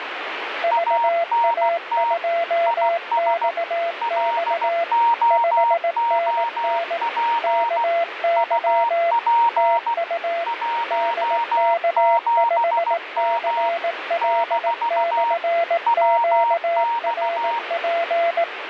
Morse code, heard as two keyed tones, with radio static. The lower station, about 18 wpm, 680 Hz: VA2XX 5NN KY TU DK5CL/QRP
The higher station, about 16 wpm, 930 Hz: ANT IS LOOP UP 17M - WX